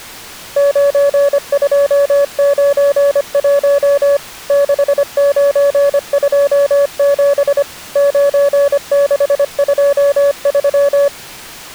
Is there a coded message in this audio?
Yes: Morse code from 0.5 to 11.1 s, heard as a keyed tone, machine-sent, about 25 wpm, 570 Hz. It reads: 9291 6927 9623